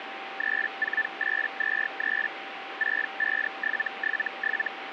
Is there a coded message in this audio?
Yes: Hellschreiber (Feld-Hell, 122.5 baud) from 0.4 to 4.7 s, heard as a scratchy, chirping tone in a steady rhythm, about 1750 Hz, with radio static and a steady whistle near 780 Hz. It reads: 34823 65777